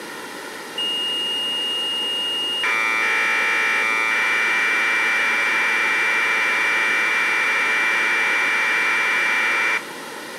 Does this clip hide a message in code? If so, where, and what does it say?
Yes: Commodore tape loading (standard loader) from 0.8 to 9.8 s, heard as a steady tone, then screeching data, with tape hiss and room echo.